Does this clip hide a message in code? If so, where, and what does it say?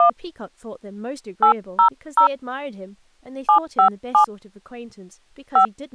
Yes: DTMF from 0.0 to 5.7 s, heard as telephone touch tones, dialled by hand, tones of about 100 ms, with speech in English. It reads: 1 800 757 5